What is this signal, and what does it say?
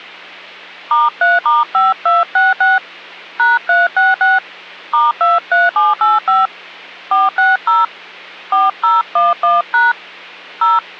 DTMF, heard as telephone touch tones, dialled by hand, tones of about 180 ms, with hum. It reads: *3*5266 #366 *23785 460 4011# 0